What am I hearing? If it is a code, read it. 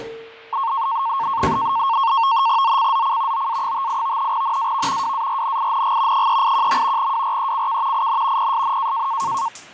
NAVTEX (SITOR-B), 100 baud, 170 Hz shift, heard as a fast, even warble, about 1000 Hz centre, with fading and kitchen noise. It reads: ZCZC OA58 NAV WARNING 381. WRECK IN PSN